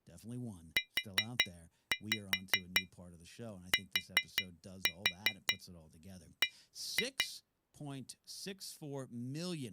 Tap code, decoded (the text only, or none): UTB